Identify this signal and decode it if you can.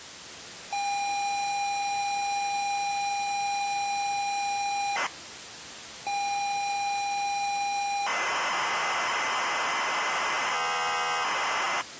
ZX Spectrum tape loading, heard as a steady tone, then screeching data, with tape hiss.